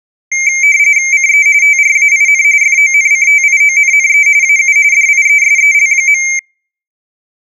RTTY (45.45 baud, 170 Hz shift), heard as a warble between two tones, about 2200 Hz centre. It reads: CE TRAIN FONCTIONNE AU DIESEL.